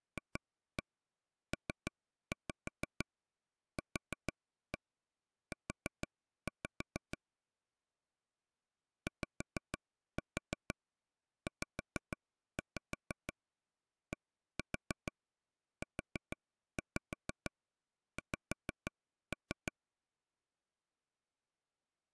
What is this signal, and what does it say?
Tap code, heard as taps on a table, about 6 knocks a second. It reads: FPQU YZDUX